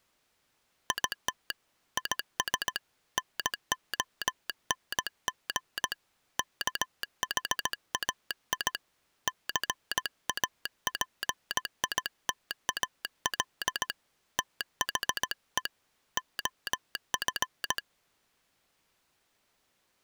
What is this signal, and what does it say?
Morse code, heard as a telegraph sounder, hand-sent with a paddle, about 17 wpm. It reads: IT IS NONG KHAI CAPITAL THE OF